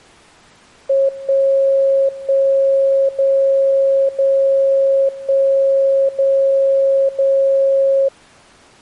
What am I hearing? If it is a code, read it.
Radio time signal (DCF77), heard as a tone whose level steps once a second, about 540 Hz. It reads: 1 1 0 0 1 0 0